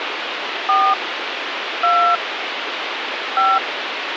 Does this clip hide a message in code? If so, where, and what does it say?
Yes: DTMF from 0.7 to 3.6 s, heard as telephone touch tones, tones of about 270 ms, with phone line noise. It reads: 4 2 5